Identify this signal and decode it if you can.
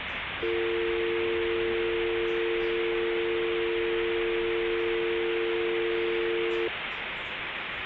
Telephone call progress tone (North American or UK plan), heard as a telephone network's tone, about 350, 450 Hz, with phone line noise and the noise inside a subway train. Dial tone.